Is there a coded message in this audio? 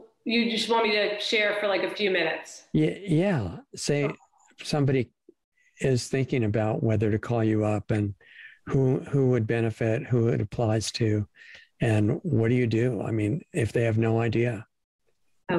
No.